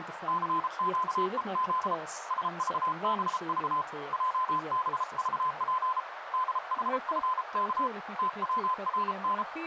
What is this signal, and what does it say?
Morse code, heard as a keyed tone, hand-sent with a paddle, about 33 wpm, 1020 Hz, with radio static, a narrow filter and speech in Swedish. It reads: CQEZ SVBV JBVP DHFK TWRN